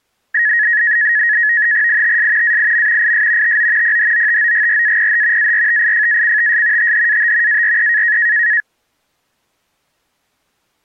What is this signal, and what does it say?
NAVTEX (SITOR-B), 100 baud, 170 Hz shift, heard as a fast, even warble, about 1800 Hz centre. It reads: ITS AIM IS TO PHOTOGRAPH ARTIFACTS THAT ARE